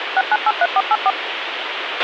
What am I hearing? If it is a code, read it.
DTMF, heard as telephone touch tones, dialled by machine, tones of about 40 ms, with radio hiss and a squelch burst at the end. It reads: 6983484